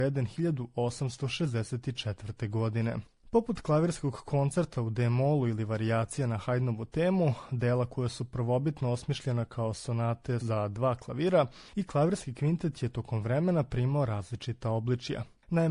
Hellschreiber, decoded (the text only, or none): none